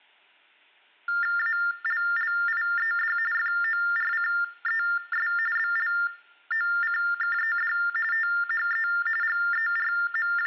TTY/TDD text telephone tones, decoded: ALLIED FORCES BLOCKED THE …

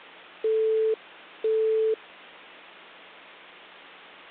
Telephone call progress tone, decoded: busy tone

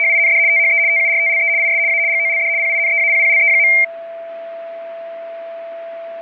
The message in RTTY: … THE TURTLE IS A GOLD PINEAPPLE.

